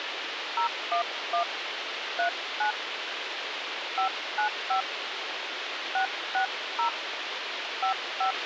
DTMF, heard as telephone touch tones, dialled by hand, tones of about 100 ms, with radio hiss and a squelch burst at the end. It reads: 011 39 595 660 55